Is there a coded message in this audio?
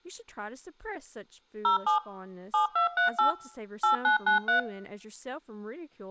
Yes: DTMF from 1.6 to 4.6 s, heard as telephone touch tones, dialled by machine, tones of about 120 ms, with room echo and speech in English. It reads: 07 7238 8993